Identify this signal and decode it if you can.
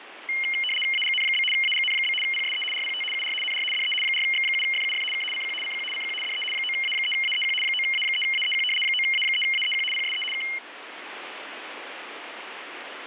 RTTY (75 baud, 850 Hz shift), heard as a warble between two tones, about 2550 Hz centre, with radio static. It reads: AGN? AGN? PSE RPT UR NR DE 4X7FUF K CQ CQ CQ DE 9A3AEQ 9A3AEQ 9A3AEQ PSE K